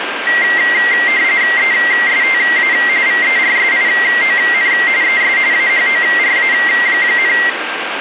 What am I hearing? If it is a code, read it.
RTTY (45.45 baud, 170 Hz shift), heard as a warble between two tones, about 2000 Hz centre, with radio static and a steady whistle near 1590 Hz. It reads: ESTA VERSION ES AHORA,